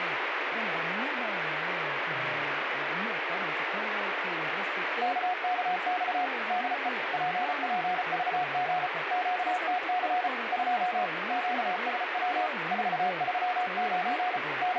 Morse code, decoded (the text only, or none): KKX DE PPVG QTC 2 QSW 439 …